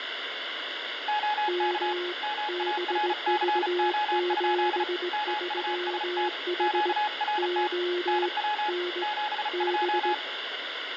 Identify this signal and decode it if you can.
Morse code, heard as two keyed tones, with radio static and room echo. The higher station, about 35 wpm, 840 Hz: OK MARCO? MUST QRT NW 72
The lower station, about 19 wpm, 360 Hz: M BV73H O N B